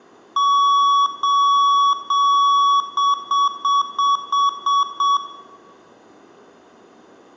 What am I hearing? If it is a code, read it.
Beep code, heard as beeps from a small speaker, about 1130 Hz, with room echo. 3 long, 7 short.